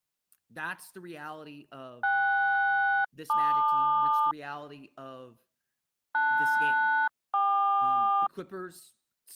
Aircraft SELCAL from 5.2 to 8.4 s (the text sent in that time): LS-KQ